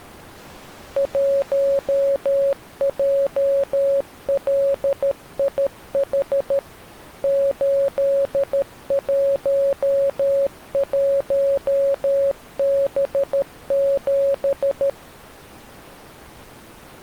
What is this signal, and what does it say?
Morse code, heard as a keyed tone, machine-sent, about 13 wpm, 550 Hz. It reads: 1JLIH 811B7